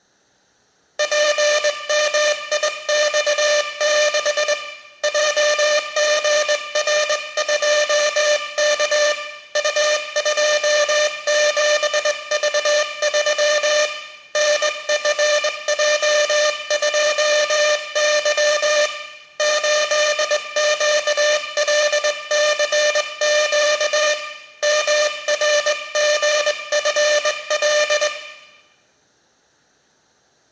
Morse code, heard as a buzzer, hand-sent with a straight key, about 20 wpm, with room echo. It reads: PMIX6 JGR2K U27V3 NFJ2Y 8QLCQ MRGFL